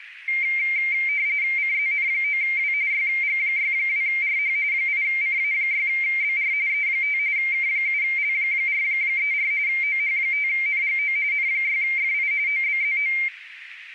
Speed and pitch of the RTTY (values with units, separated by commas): 45.45 baud, 170 Hz shift, 2200 Hz centre